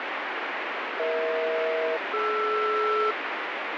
Aircraft SELCAL, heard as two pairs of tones, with heavy radio static. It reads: EH-DR